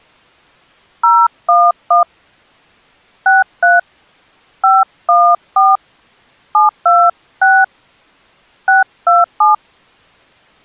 DTMF, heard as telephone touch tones, dialled by hand, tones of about 200 ms. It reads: 011 63 514 726 627